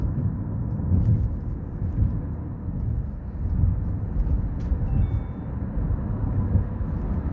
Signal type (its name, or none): none